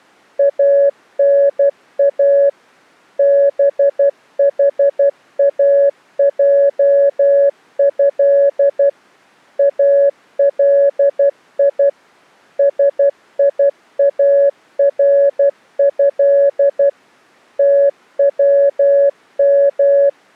Morse code (Arabic alphabet), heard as a keyed tone, machine-sent, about 12 wpm, 560 Hz. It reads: انا بحاجه الي سياره توم